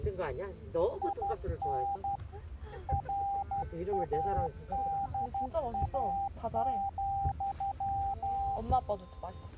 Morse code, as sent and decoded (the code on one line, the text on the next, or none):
.. -. / .-. .- -.. .- --..--
IN RADA,